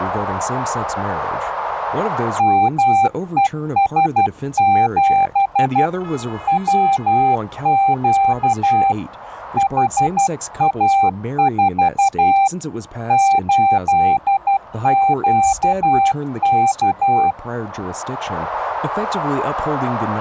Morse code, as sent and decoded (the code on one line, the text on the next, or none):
-- . ... --... / .-- --.- / .... .- ....- / ---.. --.- -.-
MES7 WQ HA4 8QK